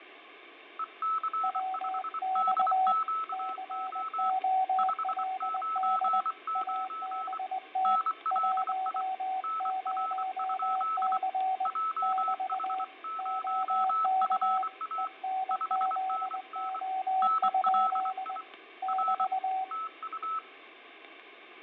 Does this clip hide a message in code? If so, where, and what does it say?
Yes: Morse code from 0.7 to 20.4 s, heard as two keyed tones, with radio static and fading. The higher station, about 24 wpm, 1300 Hz: EC5DQO 599 NLI NR? JH0FA 5NN NLI R TU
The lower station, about 20 wpm, 760 Hz: WX COLD ABT 10C <BT> OK ENZO? <BT>